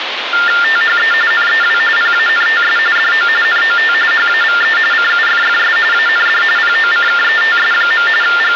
TTY/TDD text telephone tones (45.45 baud Baudot), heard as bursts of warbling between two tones, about 400 Hz shift, 1600 Hz centre, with phone line noise. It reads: THE NEW PANTS DO NOT HAVE CUFFS AND POCKETS. …